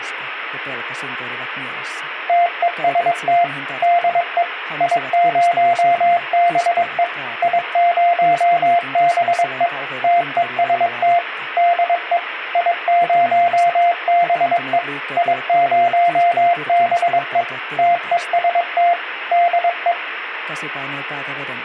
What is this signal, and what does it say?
Morse code, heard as a keyed tone, machine-sent, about 22 wpm, 700 Hz. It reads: TEST DE I0BE I0BE TEST DE I0BE I0BE TEST DE